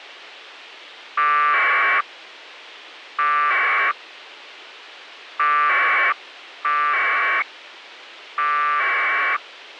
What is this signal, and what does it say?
Packet radio (AX.25, as in APRS), 1200 baud, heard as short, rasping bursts, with radio hiss.